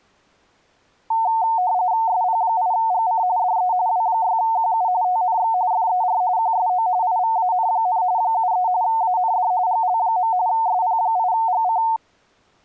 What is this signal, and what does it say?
RTTY (45.45 baud, 170 Hz shift), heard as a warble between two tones, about 810 Hz centre. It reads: SP8GC DE W6QU TNX FER QSO IVAN, 73 AND GL. SP8GC